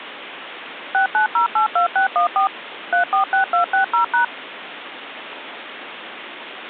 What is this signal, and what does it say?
DTMF, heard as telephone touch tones, dialled by machine, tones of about 110 ms, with phone line noise. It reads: 69082614 346260#